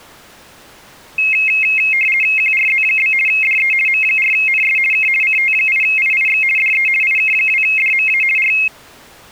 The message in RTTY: QRZ? DE M4NS K CT8IIX DE IK2DMA R

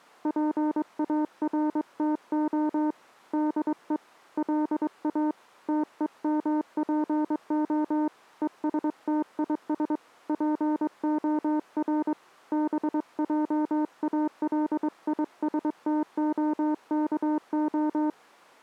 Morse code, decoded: PARTO DE LA TEMPO ESTIS POR BJALISTOKO

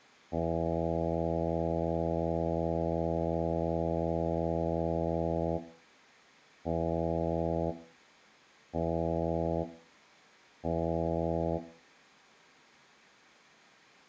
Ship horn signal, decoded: 1 long, 3 short

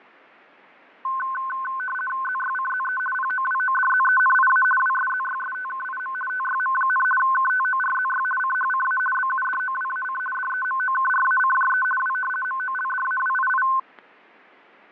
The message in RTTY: ZYCZE POWODZENIA WSZYSTKIM TYM, KTORZY CHCA BUDOWAC DEMOKRACJE W MOLDAWII

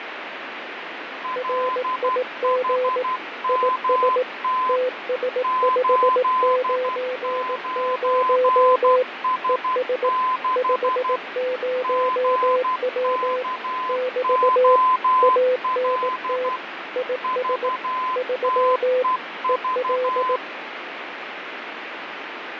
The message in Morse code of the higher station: LHMT 89S6 GKOL VTEV

